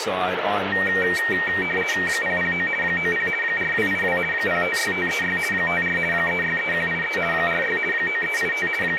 RTTY (50 baud, 450 Hz shift), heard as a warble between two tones, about 2100 Hz centre, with radio static and speech in English. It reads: 009 90 4282 056536 54 363183 46 9385 …